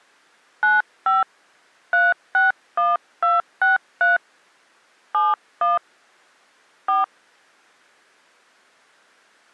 DTMF, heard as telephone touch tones, dialled by hand, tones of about 160 ms. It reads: 95 361263 71 4